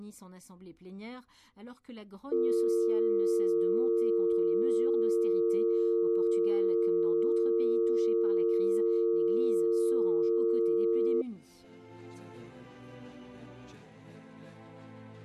Telephone call progress tone (North American or UK plan), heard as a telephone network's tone, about 350, 450 Hz. Dial tone.